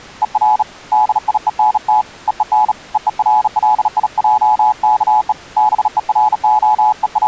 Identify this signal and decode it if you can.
Morse code, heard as a keyed tone, hand-sent with a bug key, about 37 wpm, 850 Hz. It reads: ER DIENT EEN EERLIJKE …